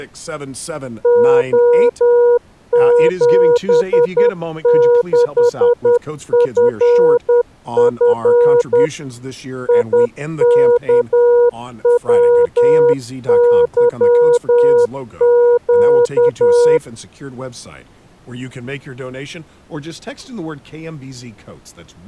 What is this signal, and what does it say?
Morse code, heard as a keyed tone, machine-sent, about 10 wpm, 480 Hz, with speech in English. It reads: O76FF IKWYQ